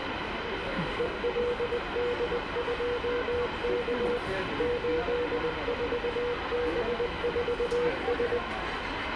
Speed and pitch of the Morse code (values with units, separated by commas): 20 wpm, 480 Hz